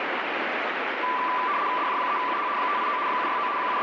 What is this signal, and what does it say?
RTTY (75 baud, 170 Hz shift), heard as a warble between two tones, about 1090 Hz centre, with radio static. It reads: DJ3UH 589 769 …